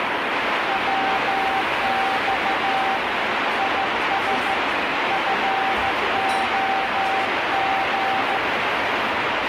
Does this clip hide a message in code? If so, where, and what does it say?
Yes: Morse code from 0.6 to 8.4 s, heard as a keyed tone, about 14 wpm, 780 Hz, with heavy radio static and the noise of a restaurant. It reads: WX IS FOG